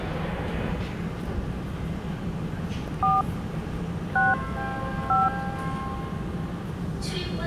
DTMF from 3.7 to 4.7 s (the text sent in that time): 6